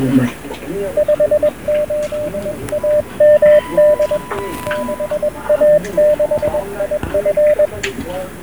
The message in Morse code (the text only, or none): 58AMD 6A6IF